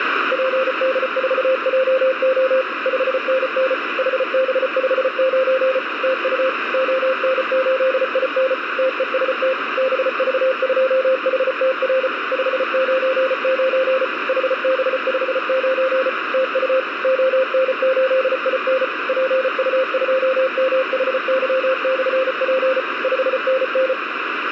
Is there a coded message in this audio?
Yes: Morse code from 0.3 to 24.0 s, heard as a keyed tone, machine-sent, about 34 wpm, 520 Hz, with radio static. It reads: PD4JO 5NN HB59 TU ON8IN TEST BV2HTR 599 HB59 TU ON8IN PU2MHY/P 5NN